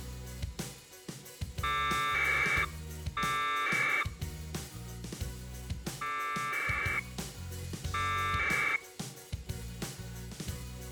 Packet radio (AX.25, as in APRS), 1200 baud, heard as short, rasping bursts.